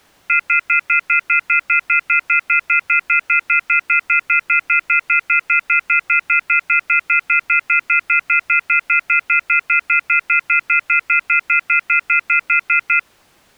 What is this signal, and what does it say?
Telephone call progress tone (North American plan), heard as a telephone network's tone, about 1400, 2050, 2450, 2600 Hz, 0.1 s on and 0.1 s off. Off-hook warning tone.